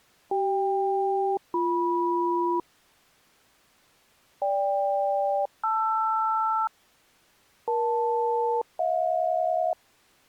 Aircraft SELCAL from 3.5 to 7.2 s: GK-LR

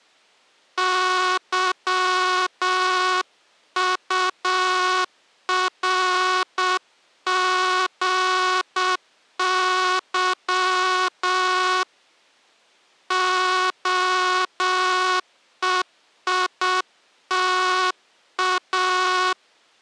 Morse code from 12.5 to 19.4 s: OEITA

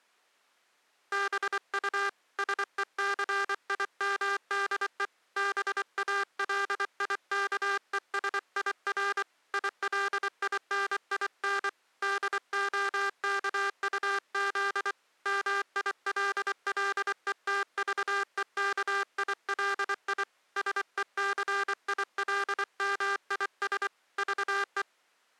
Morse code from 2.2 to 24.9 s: SECIMDE BALIKESIR ILININ DOKUZ MILLETVEKILI SECILMIS VE

